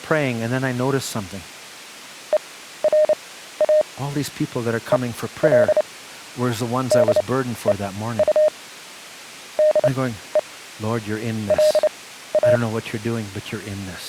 Morse code, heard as a keyed tone, machine-sent, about 29 wpm, spaced as for 14 wpm, 610 Hz, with speech in English. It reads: ERA EL DEU DE LA